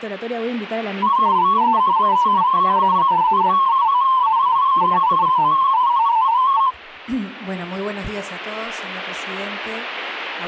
Multi-tone FSK (Olivia or MFSK type), about 250 Hz wide, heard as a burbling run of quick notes, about 31.25 baud.